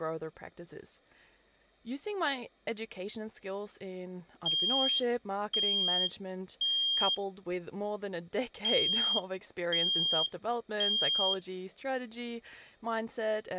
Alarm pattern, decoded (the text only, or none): temporal three